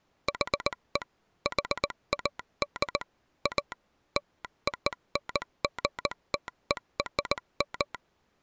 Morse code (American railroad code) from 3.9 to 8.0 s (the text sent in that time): LONGTERM